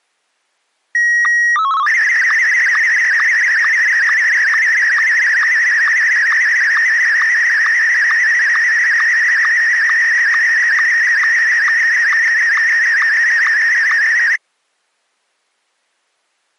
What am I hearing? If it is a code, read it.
SSTV (slow-scan television), Martin M1, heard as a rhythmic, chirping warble.